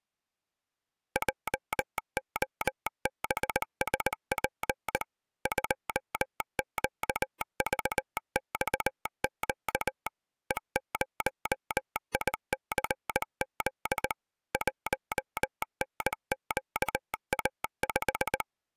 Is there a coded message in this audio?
Yes: Morse code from 1.1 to 18.5 s, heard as a telegraph sounder, machine-sent, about 19 wpm. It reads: JOBSP 2QVXQ E0ICZ 1NQA5